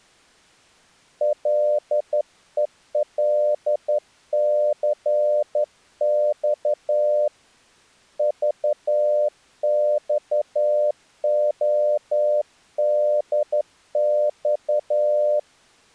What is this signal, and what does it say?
Morse code, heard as a keyed tone, hand-sent with a straight key, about 11 wpm, 600 Hz. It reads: LELCX VXODX